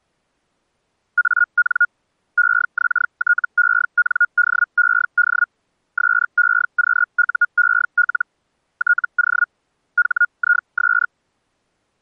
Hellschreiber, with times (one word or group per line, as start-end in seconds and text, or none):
1.2-1.9 AN
2.4-5.5 EXTENDED
6.0-8.3 SEQUEL
8.8-9.5 TO
10.0-11.1 HIS